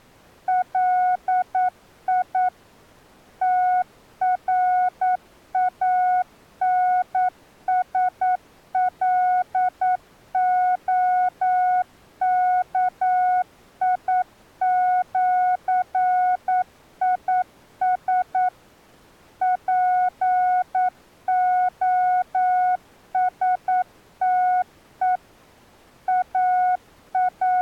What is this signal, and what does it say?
Morse code (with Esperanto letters), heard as a keyed tone, machine-sent, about 9 wpm, 730 Hz. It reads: LI TRANSLOKIĜIS POSTE …